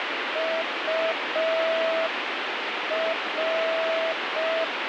Morse code, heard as a keyed tone, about 5 wpm, 650 Hz, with heavy radio static. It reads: UR